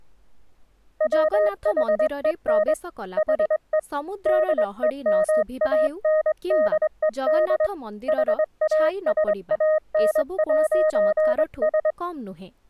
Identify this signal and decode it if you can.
Morse code, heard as a keyed tone, hand-sent with a straight key, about 23 wpm, 620 Hz, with speech in Odia. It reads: WHEN HE DEMANDED HASAN'S